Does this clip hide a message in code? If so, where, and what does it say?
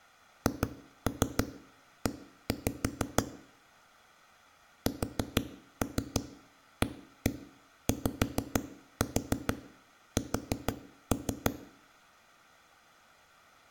Yes: tap code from 0.5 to 11.5 s, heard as knocks on a wall, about 6 knocks a second, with room echo. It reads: HE SAYS